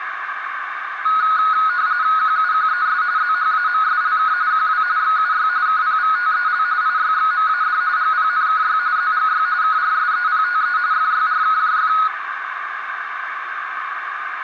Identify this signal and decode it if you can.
RTTY (45.45 baud, 170 Hz shift), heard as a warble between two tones, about 1360 Hz centre, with radio static and a narrow filter. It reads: QUQES ZHAMSLK QW XUY KPVTEL IYXMAD GPNKY ZGY KRSEPTE FYRKJF